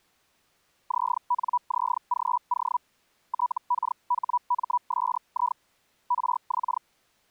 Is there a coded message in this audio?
Yes: Hellschreiber (Feld-Hell, 122.5 baud) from 0.9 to 6.8 s, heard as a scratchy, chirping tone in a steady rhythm, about 980 Hz. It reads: ZNZGO TKHMSI RX